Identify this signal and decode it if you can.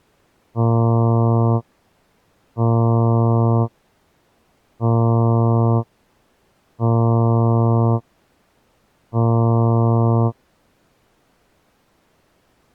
Ship horn signal, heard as a ship's horn, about 120 Hz. 5 short. At sea: I doubt that you are doing enough to avoid a collision.